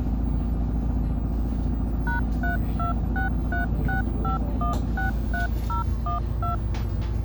DTMF, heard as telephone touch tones, dialled by machine, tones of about 130 ms, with the noise inside a bus. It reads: #326365163012